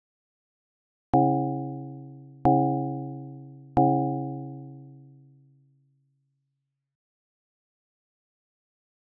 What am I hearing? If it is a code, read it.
Clock strike, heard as a bell. 3. Three o'clock.